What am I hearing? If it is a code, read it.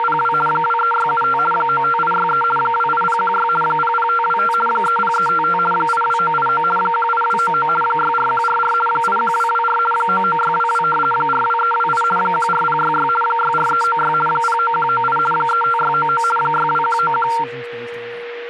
RTTY (50 baud, 450 Hz shift), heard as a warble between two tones, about 1150 Hz centre, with a steady whistle near 480 Hz and speech in English. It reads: … 23675 95863 28016 00525 30355 82989 18299 64144 81224 99622 42328 14066 64396 09198 35699 62191